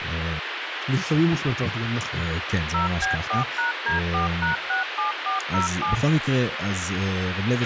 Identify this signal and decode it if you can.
DTMF, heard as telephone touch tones, dialled by machine, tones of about 130 ms, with radio hiss, a squelch burst at the end and speech in Hebrew. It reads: 0B4#D4#67407